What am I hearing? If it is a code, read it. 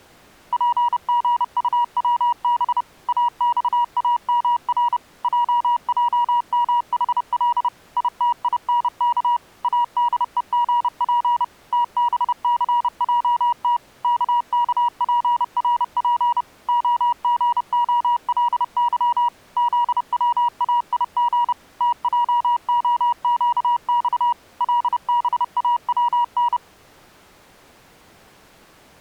Morse code, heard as a keyed tone, machine-sent, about 30 wpm, 960 Hz. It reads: PGUWB AXAMR JJMHL ITINK ADEGP TBCJT KKPRP OGOLY ZWAIG TJOQX LBAWN